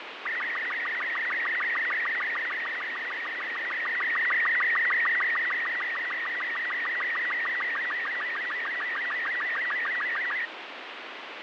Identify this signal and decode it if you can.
SSTV (slow-scan television), Robot 36, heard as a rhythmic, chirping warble, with radio static and fading.